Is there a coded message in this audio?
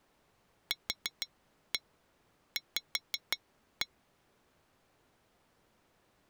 Yes: tap code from 0.7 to 3.9 s, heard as taps on glass, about 5 knocks a second. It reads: QV